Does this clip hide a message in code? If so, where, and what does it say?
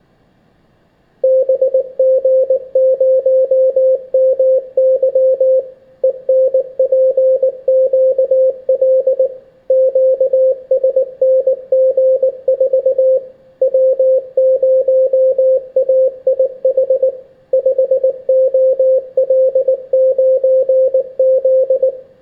Yes: Morse code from 1.2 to 21.9 s, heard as a keyed tone, machine-sent, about 19 wpm, 520 Hz, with room echo. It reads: BG0MY ENPQL QSNG4 W0AIH 5OL9Z